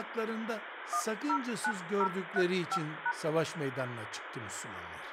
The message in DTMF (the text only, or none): 109035#